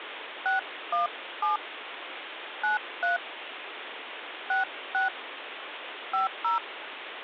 DTMF, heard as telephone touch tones, dialled by hand, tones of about 140 ms, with phone line noise. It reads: 617 93 66 50